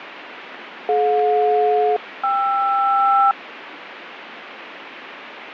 Aircraft SELCAL, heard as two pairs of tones, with radio static. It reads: DJ-KR